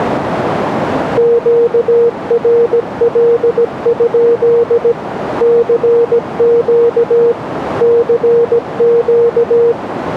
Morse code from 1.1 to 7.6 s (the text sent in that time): QRL? CQ